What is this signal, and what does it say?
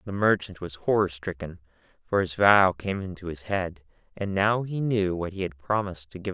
Speech in English. There is no code.